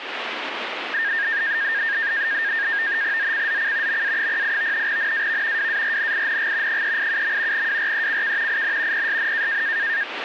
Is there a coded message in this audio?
Yes: NAVTEX (SITOR-B), 100 baud, 170 Hz shift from 0.9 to 10.0 s, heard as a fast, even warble, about 1700 Hz centre, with radio static. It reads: ZCZC MA08 NAV WARNING 387. WRECK IN PSN